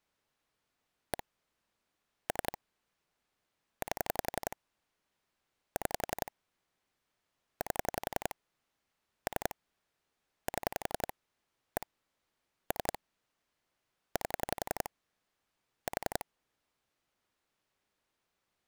Pulse dialling, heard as clicks on a phone line, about 11 pulses a second. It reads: 1 3 8 6 8 3 7 1 3 8 4